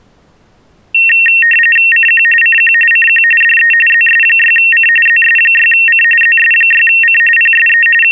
RTTY (45.45 baud, 850 Hz shift), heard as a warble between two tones, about 2300 Hz centre. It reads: CQ CQ CQ DE ZS6C ZS6C ZS6C PSE …